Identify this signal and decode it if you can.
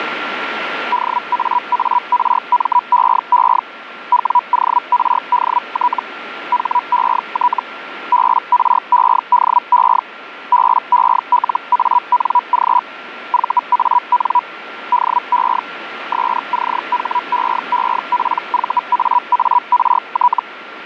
Hellschreiber (Feld-Hell, 122.5 baud), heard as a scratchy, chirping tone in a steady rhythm, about 980 Hz, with radio static and a steady whistle near 1370 Hz. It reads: DAARMEE WORDT HET BREDE BELANG VAN DE SCHEEPVAART